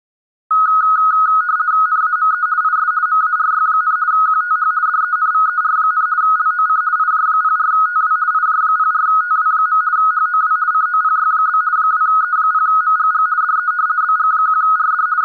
RTTY (50 baud, 170 Hz shift), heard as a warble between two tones, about 1360 Hz centre. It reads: NAME IS MARY, QTH DENVER, LOC IJ04TW IJ04TW. HOW COPY? 2E0MGG DE BG1RD …